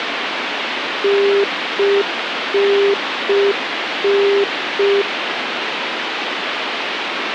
Telephone call progress tone (UK plan), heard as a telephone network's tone, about 400 Hz, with phone line noise. Congestion tone.